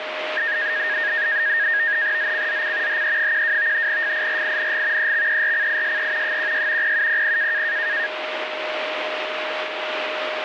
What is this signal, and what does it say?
NAVTEX (SITOR-B), 100 baud, 170 Hz shift, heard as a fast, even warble, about 1750 Hz centre, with radio static and a steady whistle near 620 Hz. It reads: ZCZC HE12 FIRING EXERCISE 16 0700